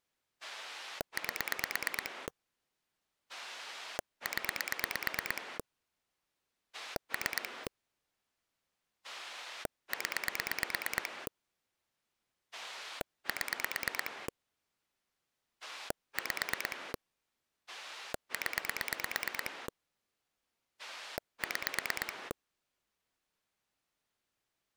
Pulse dialling, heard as a rotary dial, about 9 pulses a second. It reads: 8 0 3 0 7 5 0 6